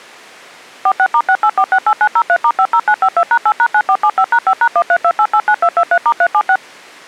DTMF, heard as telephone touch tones, dialled by machine, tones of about 60 ms. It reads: 46*68468903*50952#8#9475#5#132889223*376